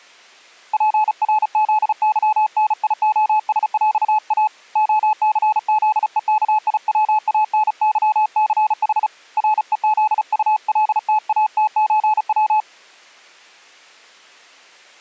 Morse code (with Polish letters), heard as a keyed tone, hand-sent with a paddle, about 35 wpm, 860 Hz. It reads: PRZYNIOSŁA OCZEKIWANYCH REZULTATÓW